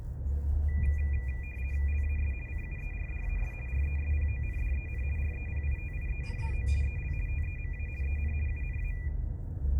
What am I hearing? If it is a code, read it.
RTTY (50 baud, 450 Hz shift), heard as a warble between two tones, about 2200 Hz centre, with the noise inside a car. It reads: LAS CUERDAS RESPONDEN REPITIENDO EL TEMA EN UNA